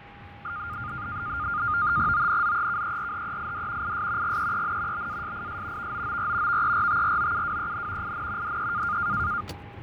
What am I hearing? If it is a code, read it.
NAVTEX (SITOR-B), 100 baud, 170 Hz shift, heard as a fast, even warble, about 1310 Hz centre, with radio static, fading, a steady whistle near 810 Hz and the noise inside a car. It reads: ONZEKERHEID IS GEEN BASIS VOOR VERTROUWEN IN DE